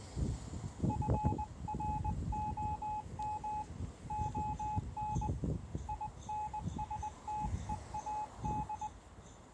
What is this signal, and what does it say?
Morse code, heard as a keyed tone, hand-sent with a paddle, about 20 wpm, 850 Hz, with street noise. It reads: FROM ON INSTEAD